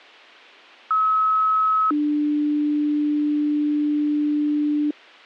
Two-tone page, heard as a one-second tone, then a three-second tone, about 1290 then 300 Hz.